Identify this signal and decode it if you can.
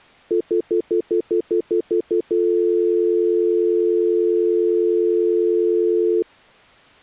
Telephone call progress tone (North American plan), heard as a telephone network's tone, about 350, 440 Hz, 0.1 s on and 0.1 s off. Stutter dial tone.